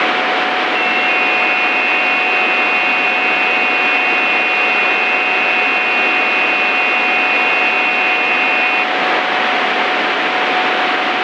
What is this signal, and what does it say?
FT8 (several signals at once), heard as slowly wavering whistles, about 6.25 baud, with radio static and a steady whistle near 740 Hz.